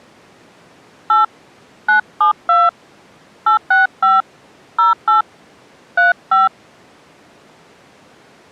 DTMF, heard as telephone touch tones, dialled by hand, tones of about 160 ms. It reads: 8 972 865 08 35